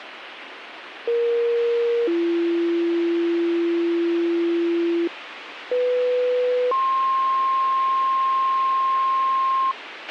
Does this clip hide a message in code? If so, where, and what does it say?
Yes: two-tone page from 1.1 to 9.7 s, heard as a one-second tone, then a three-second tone, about 470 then 340 Hz, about 500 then 1060 Hz, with radio hiss and a squelch burst at the end.